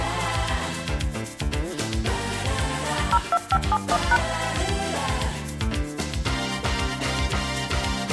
DTMF, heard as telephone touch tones, dialled by machine, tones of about 50 ms. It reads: 02571#